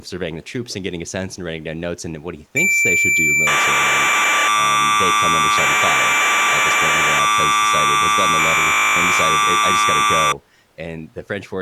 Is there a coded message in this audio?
Yes: cassette data (Kansas City type), 1200 baud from 2.6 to 10.3 s, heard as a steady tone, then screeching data, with speech in English.